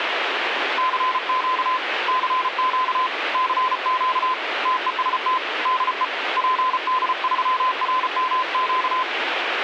Morse code, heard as a keyed tone, hand-sent with a paddle, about 34 wpm, 1020 Hz, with radio static. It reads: CQ CQ CQ TEST DE PD3RMQ